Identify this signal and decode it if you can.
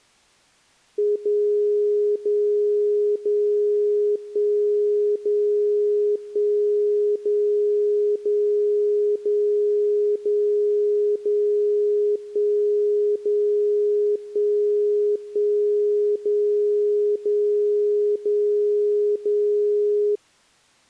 Radio time signal (DCF77), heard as a tone whose level steps once a second, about 420 Hz. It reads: 0 0 0 1 0 1 0 0 0 0 0 1 0 1 1 0 0 0 0